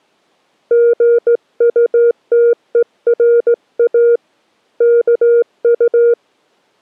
Morse code, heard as a keyed tone, hand-sent with a straight key, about 17 wpm, 470 Hz. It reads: GUTERA KU